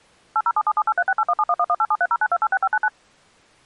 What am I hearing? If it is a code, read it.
DTMF, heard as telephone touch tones, dialled by machine, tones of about 50 ms. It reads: 8077783681711187309286599